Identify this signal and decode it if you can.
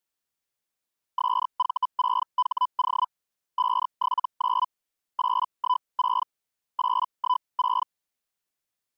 Hellschreiber (Feld-Hell, 122.5 baud), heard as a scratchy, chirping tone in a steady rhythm, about 1000 Hz. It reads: SV6HO 579 816 816